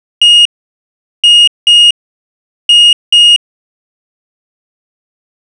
Beep code, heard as a piezo beeper, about 2850 Hz. 1-2-2. In Phoenix BIOS tables: DMA initialisation failure.